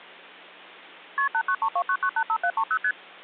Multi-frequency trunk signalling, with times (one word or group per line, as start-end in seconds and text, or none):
1.2-1.3 KP
1.3-2.8 89329985730
2.8-2.9 ST